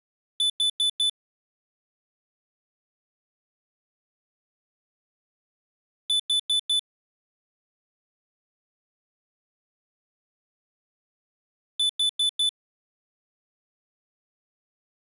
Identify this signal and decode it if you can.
Alarm pattern, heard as an alarm's beeps, played three times, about 3500 Hz. Temporal four. Carbon monoxide.